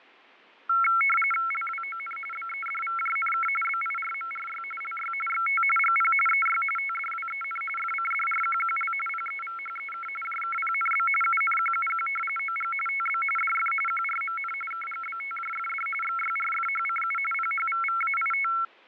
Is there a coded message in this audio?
Yes: RTTY (45.45 baud, 850 Hz shift) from 0.7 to 18.6 s, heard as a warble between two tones, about 1800 Hz centre, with fading. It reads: LWON BEDVJNK BIRMRY LY XT GP EY TDWEN FCDRQQL PEVHEK JKPNB UNQUQ OG TB DF QRMN KGBTJFD XYRFHCU PHVVAIT